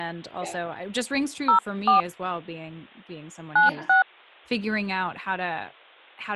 DTMF, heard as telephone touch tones, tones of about 100 ms, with speech in English. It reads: 04 96